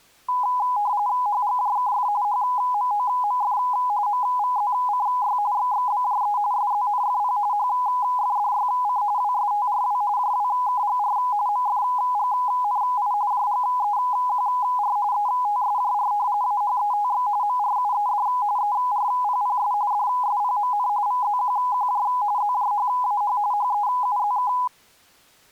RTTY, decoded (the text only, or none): HGJKF HMOMF MVZCY XXBJE SZNFP HFDYC WSTRW JWKGR MFGNI JGEQR ETSJR AHETX MRUED ERPPS DSPMN VZQQJ ZJHAH HEUZK